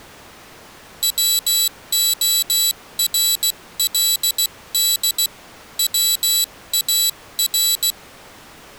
Morse code, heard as a high beeper, hand-sent with a paddle, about 16 wpm, 3950 Hz. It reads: WORLD WAR